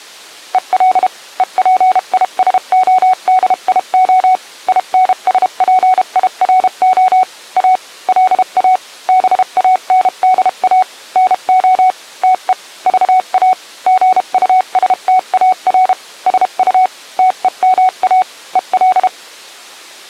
Morse code, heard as a keyed tone, machine-sent, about 32 wpm, spaced as for 29 wpm, 740 Hz. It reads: EL EPISODIO INSPIRO A LA BANDA NO TE VA GUSTAR SU TEMA EL